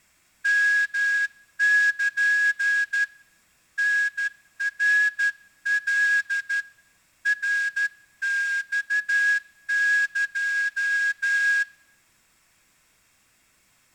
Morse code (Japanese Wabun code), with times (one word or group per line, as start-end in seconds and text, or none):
0.5-3.0 ヨル
3.8-6.6 タナカ
7.3-11.6 ナマエ